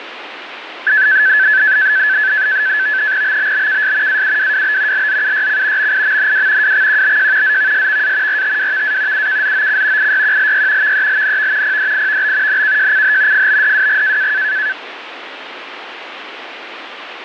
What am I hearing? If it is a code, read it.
NAVTEX (SITOR-B), 100 baud, 170 Hz shift, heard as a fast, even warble, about 1650 Hz centre, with radio static. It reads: BBBKS AUWWB LZUYC MIMNW WXQBJ ZVSVA RTWVA UKZOC IYQLY VELNV PDIVB NKJCH FBDWG